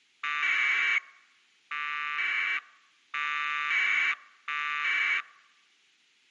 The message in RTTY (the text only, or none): none